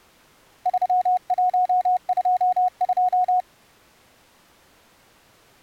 Morse code, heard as a keyed tone, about 30 wpm, 730 Hz. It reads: 3122